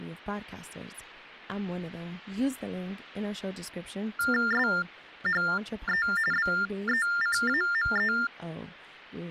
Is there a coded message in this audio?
Yes: TTY/TDD text telephone tones (45.45 baud Baudot) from 4.2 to 8.3 s, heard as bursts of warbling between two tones, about 400 Hz shift, 1600 Hz centre, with speech in English. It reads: SHE BECAME